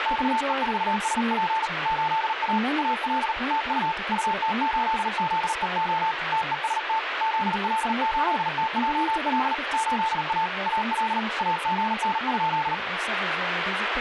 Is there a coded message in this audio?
Yes: Morse code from 0.0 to 12.8 s, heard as a keyed tone, hand-sent with a paddle, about 39 wpm, 890 Hz, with radio static and speech in English. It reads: XE4SP 8A AL TU UT8ZEO TEST ZL8TJL 8A AL AGN?